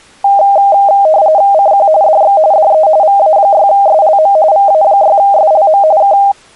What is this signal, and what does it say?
RTTY (45.45 baud, 170 Hz shift), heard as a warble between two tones, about 710 Hz centre. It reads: CQ DX DE VA6SLM VA6SLM K